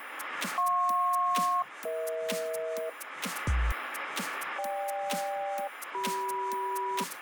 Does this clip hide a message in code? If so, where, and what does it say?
Yes: aircraft SELCAL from 0.6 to 7.0 s, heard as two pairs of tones, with radio static. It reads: JP-EH GK-CM